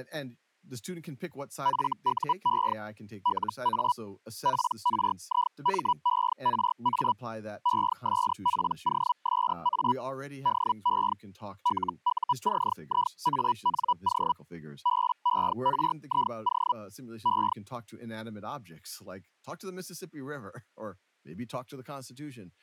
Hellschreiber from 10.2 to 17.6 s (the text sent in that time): DE LUCIANO BERIO E